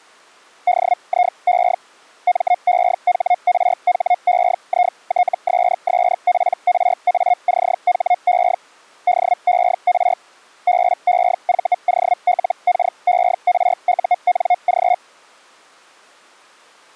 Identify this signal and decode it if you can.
Hellschreiber (Feld-Hell, 122.5 baud), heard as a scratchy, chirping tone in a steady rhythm, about 720 Hz. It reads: DIE MEHRHEITSSPRACHE DER BEVOLKERUNG